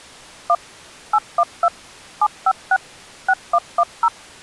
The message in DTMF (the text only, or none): 1 812 756 6110